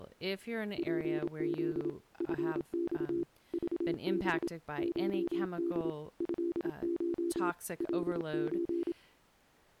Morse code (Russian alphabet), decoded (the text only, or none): ПЗ ФЬ ЖБ ШД ЭШ ЛЧ